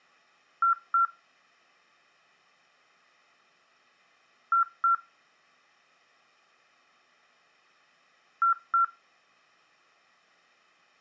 Beep code, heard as beeps, played three times, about 1360 Hz. 2 short. In AMI BIOS tables: memory parity error; in IBM BIOS tables: self-test error shown on screen; in Dell tables: no memory detected.